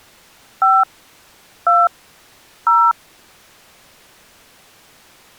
DTMF, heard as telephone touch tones, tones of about 220 ms. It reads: 5 2 0